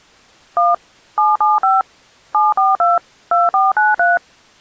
DTMF, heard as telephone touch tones, dialled by machine, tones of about 180 ms. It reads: 1 775 742 2493